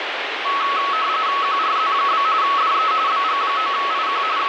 RTTY (45.45 baud, 170 Hz shift), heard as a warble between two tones, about 1200 Hz centre, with radio static. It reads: QRZ? DE BG9IQ …